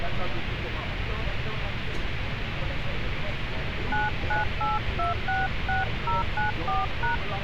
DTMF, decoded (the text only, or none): 998266094#